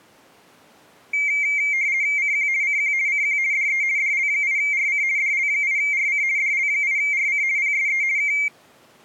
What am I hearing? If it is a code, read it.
RTTY (50 baud, 170 Hz shift), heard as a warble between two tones, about 2200 Hz centre. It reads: CQ CQ CQ DE DL8RC DL8RC DL8RC PSE K